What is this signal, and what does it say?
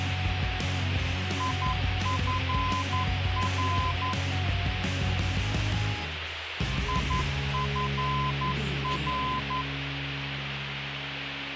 Morse code, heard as a keyed tone, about 11 wpm, 1020 Hz, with radio hiss. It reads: IFR IFR